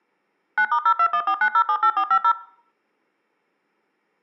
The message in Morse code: none

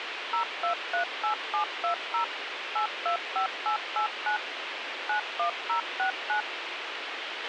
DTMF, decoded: 0238720 825889 91069

